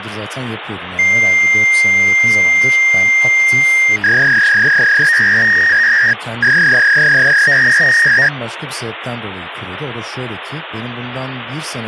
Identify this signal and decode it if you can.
Fax machine handshake, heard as a long tone and a warble, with phone line noise and speech in Turkish.